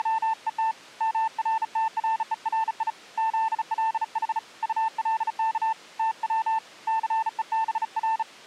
Morse code, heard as a keyed tone, hand-sent with a bug key, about 35 wpm, 890 Hz. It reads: … MRTRERI ZLH ULK TW CEBR